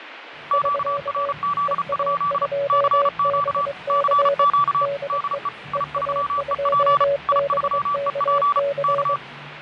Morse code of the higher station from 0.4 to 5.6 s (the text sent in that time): QRZ? CQ CQ DE